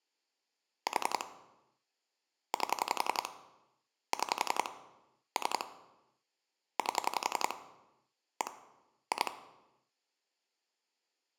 Pulse dialling, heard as clicks on a phone line, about 11 pulses a second, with room echo. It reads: 4 8 6 3 8 1 2